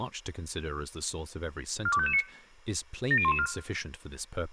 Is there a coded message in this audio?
Yes: five-tone selective call (ZVEI) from 1.9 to 3.5 s, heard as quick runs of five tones, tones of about 70 ms, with room echo and speech in English. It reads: 42559 70114